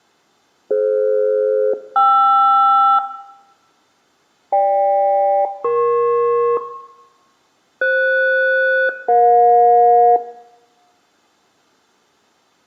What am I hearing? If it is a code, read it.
Aircraft SELCAL, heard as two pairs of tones, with room echo. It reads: DF-KR GK-EP FS-EJ